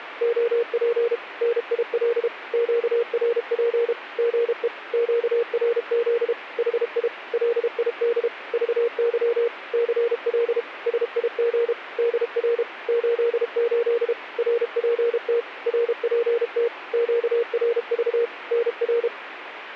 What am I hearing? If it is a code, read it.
Morse code, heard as a keyed tone, machine-sent, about 32 wpm, 470 Hz, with radio static. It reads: OP NIL QRP GE QRZ HI LID VY CL SIG DR 88 RPT RPT QRV NR